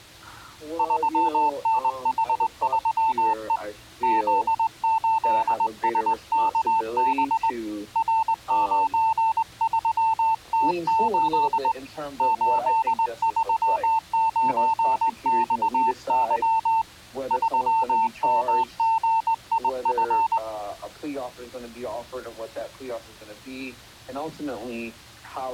Morse code, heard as a keyed tone, hand-sent with a straight key, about 20 wpm, 890 Hz. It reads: 3NH3E Z8SKB R93T8 839XY 3MGIF